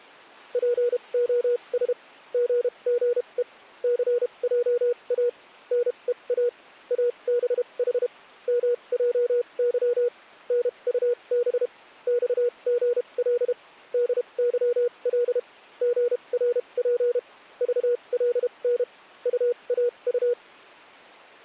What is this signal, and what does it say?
Morse code, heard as a keyed tone, machine-sent, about 32 wpm, spaced as for 26 wpm, 480 Hz. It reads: POS GGE CJA NEA ABH MJY NUB XGL DYL GRP VLN UAU